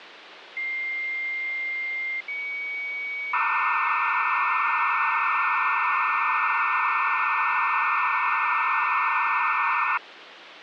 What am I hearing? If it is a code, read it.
Dial-up modem handshake (low-speed, two carriers), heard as two whistles, then hiss, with phone line noise.